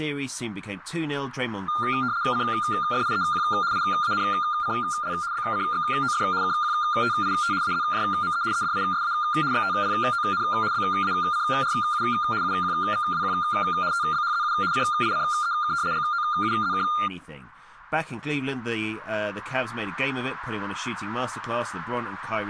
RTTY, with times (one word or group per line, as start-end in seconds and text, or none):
2.3-3.4 CFIEQ
3.7-5.1 IANCL
5.3-6.2 BCXOF
6.4-7.5 KQTIT
7.6-8.4 AZJME
8.5-9.1 EDISA
9.5-10.4 XTPON
10.7-12.0 BACRU
12.4-13.3 UQVWQ
13.9-14.5 TBHZU
14.7-15.7 CICEK
15.9-16.8 GOUZK